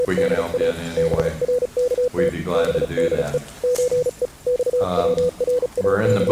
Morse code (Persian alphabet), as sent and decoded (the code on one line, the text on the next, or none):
… / -... .-. -.- - / -... -.. . / ---. . / …
… برکت بده چه …